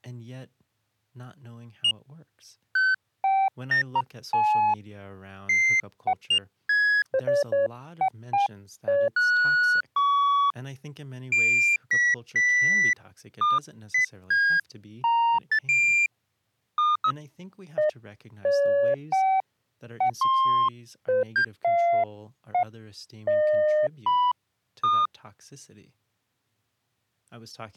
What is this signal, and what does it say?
Electronic bleeps of random pitch and length, with speech in English. There is no code.